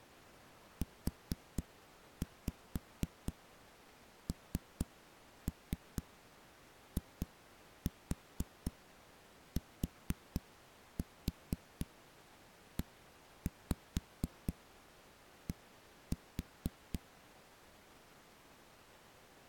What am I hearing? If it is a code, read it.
Tap code, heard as knocks on a wall, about 4 knocks a second. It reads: UNITED